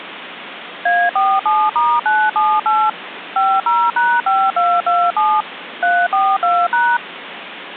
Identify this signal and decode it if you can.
DTMF, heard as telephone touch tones, dialled by machine, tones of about 240 ms, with phone line noise. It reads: A47*978 50#5227 342#